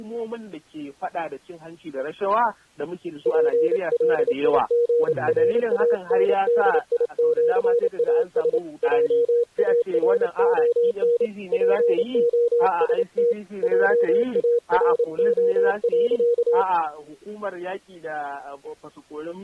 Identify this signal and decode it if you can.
Morse code (with Esperanto letters), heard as a keyed tone, hand-sent with a paddle, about 28 wpm, 480 Hz. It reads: PLIGRANDIĜAS JARON POST JARO.